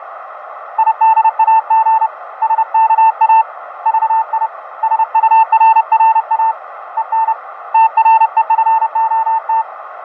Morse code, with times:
0.8-2.1 IDAG
2.4-3.4 SKA
3.9-4.5 VI
4.8-6.5 SURRA
7.0-7.3 EN
7.7-9.6 TREFOT

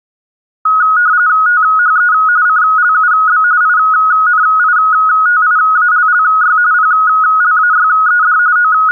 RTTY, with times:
1.5-2.1 THE
2.5-3.4 CLUB
3.6-6.6 INITIALLY
6.7-8.4 PLAYED
8.6-8.9 …

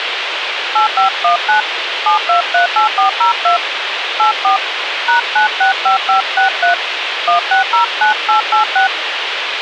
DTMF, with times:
0.8-1.6 8519
2.1-3.6 7238402
4.2-4.6 84
5.1-6.7 #965563
7.3-8.9 1609886

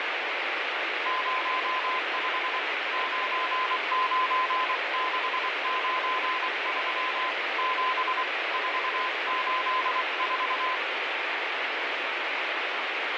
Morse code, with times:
1.1-2.6 05
2.9-7.3 99693
7.6-8.2 7
8.5-10.8 484

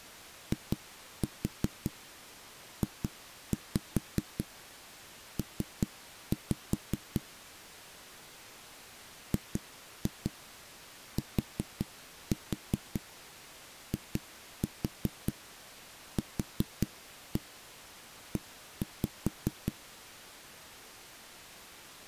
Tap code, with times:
0.5-7.2 IJP
9.3-19.7 GTIQE

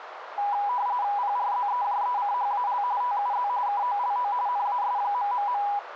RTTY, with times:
1.2-2.8 PRZEJECHAL
3.0-3.5 TUZ
3.7-4.3 KOLO
4.5-5.6 NAS...

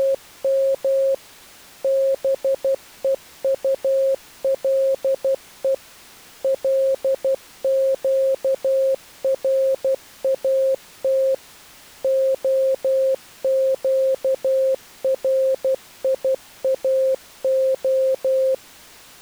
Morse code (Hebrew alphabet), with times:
0.0-1.1 …
1.8-5.7 בוטלו
6.4-11.3 לקראת
12.0-18.5 הקריאה

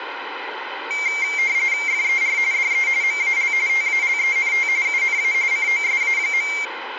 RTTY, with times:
1.9-2.4 FER
2.5-2.9 DE
3.0-3.5 MAL
3.7-4.7 TALENT
4.9-5.3 UNA
5.5-6.5 COSA.

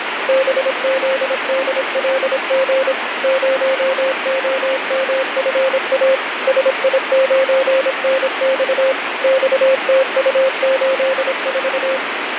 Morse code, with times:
0.3-2.9 BZDLG
3.2-6.1 0OMFA
6.5-8.9 SI9NX
9.2-12.0 XTU84

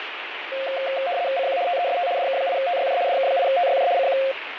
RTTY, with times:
1.4-1.6 CQ
1.7-2.1 TEST
2.2-3.0 DK8TYJ
3.1-3.9 DK8TYJ
4.0-4.2 CQ

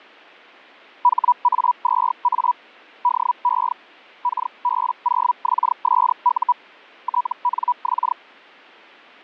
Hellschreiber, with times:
1.0-2.5 HA2A
3.0-3.7 DE
4.2-6.5 KB0XSU
7.0-8.1 TNX

